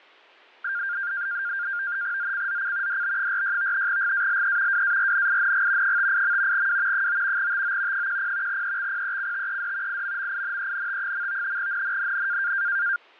NAVTEX (SITOR-B), 100 baud, 170 Hz shift, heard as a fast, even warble, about 1500 Hz centre. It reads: ZCZC DB46 GALE WARNING 58. W 9 TO 10 EXPECTED IMMINENT. NNNN